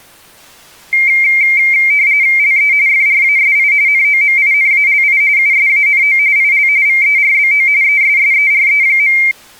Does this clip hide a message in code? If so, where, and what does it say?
Yes: RTTY (45.45 baud, 170 Hz shift) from 0.9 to 9.3 s, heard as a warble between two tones, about 2200 Hz centre. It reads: LE FRASI NOMINALI USANO IL VERBO ESSERE.